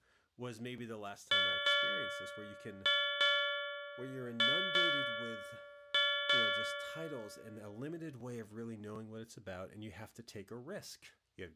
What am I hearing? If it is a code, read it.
Ship's bell, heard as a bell, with speech in English. 8. Eight half-hours of the watch have passed.